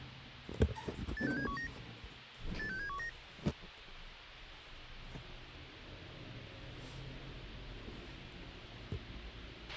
Five-tone selective call (CCIR), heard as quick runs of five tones, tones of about 100 ms, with radio hiss, a squelch burst at the end and the noise inside a lift. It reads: 86719 86719